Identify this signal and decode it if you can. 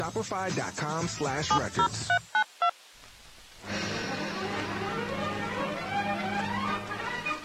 DTMF, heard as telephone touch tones, dialled by hand, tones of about 80 ms. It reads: 70392